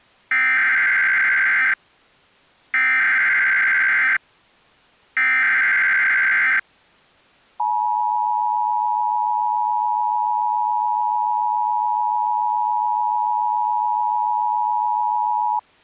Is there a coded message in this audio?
Yes: Emergency Alert System (SAME) tones (header bursts, then the 853 and 960 Hz attention tone) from 0.3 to 15.6 s, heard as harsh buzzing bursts, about 520.83 baud.